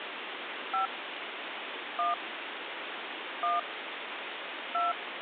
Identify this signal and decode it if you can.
DTMF, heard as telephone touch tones, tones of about 140 ms, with phone line noise. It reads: 5 1 1 2